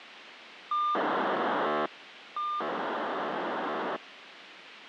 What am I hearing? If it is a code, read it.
POCSAG pager data (2400 baud), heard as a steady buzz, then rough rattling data, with radio hiss.